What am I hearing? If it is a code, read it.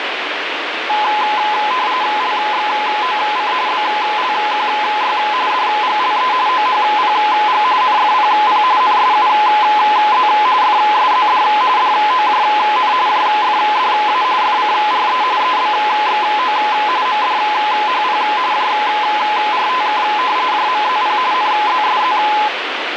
RTTY (45.45 baud, 170 Hz shift), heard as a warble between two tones, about 930 Hz centre, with radio static. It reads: LXOC BLQY DGLE OHPG NFPP NSUZ FSZD DOJN JFDA FCRE EBXO MDHP JRTK JMZP NZSZ